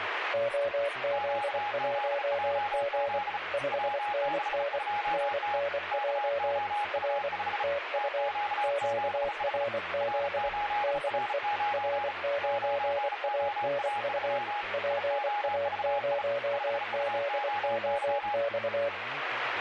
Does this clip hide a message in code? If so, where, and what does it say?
Yes: Morse code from 0.3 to 18.9 s, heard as two keyed tones, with radio static and speech in Russian. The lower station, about 24 wpm, 570 Hz: OZ1G 5NN NNJ R TU QRZ DE R9ANU PA0ZOX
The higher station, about 35 wpm, 830 Hz: QZJZ W62T KOU5 TQ7H R8R9 9OA3 IOVI 5UOY